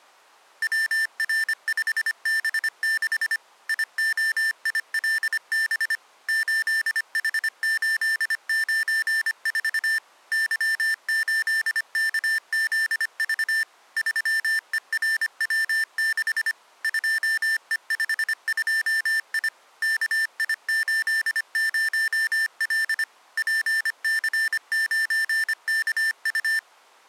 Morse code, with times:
0.6-3.4 WR5B6
3.7-6.0 IOILB
6.3-10.0 8H894
10.3-13.6 Y8KZV
14.0-16.5 3ERW6
16.8-19.5 2E52I
19.8-23.0 KI80L
23.4-26.6 PC9KU

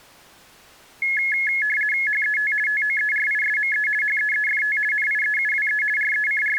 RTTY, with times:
2.1-2.5 HET
2.7-3.9 TOERISME
4.0-4.8 HEEFT
4.9-5.8 NIEUWE
6.0-6.6 …

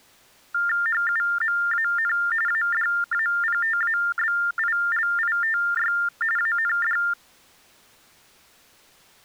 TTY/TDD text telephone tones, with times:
0.9-2.1 HUMAN
2.5-5.9 ADAPTABILITY
6.4-7.0 AND

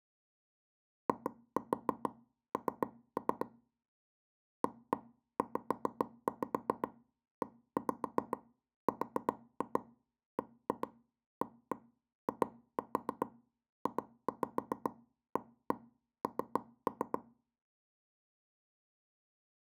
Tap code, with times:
1.1-3.5 IN
4.6-17.2 AZERBAIJAN

